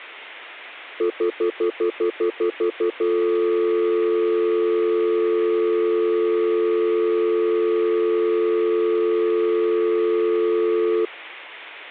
Telephone call progress tone (North American plan), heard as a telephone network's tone, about 350, 440 Hz, 0.1 s on and 0.1 s off. Stutter dial tone.